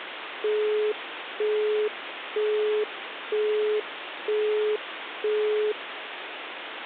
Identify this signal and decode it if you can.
Telephone call progress tone (single-tone plan, as in Europe, Japan and elsewhere), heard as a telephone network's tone, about 420 Hz, 0.48 s on and 0.48 s off, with phone line noise. Busy tone.